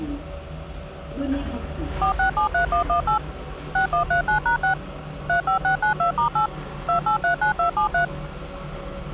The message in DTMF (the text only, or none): 4673118 6139#6 35692*8 2839273